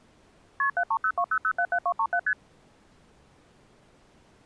Multi-frequency trunk signalling (R1, as on North American trunks), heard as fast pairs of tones, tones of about 70 ms. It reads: KP 73020077237 ST